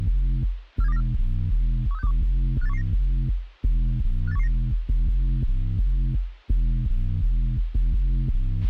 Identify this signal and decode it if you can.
Five-tone selective call (EEA), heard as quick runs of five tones, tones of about 40 ms, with radio hiss and a squelch burst at the end. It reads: 47294 13621 58119 58119